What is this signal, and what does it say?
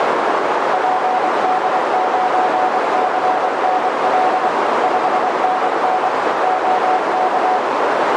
Morse code, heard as a keyed tone, machine-sent, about 24 wpm, 740 Hz, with heavy radio static and a narrow filter. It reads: PD9CNL 5NN OK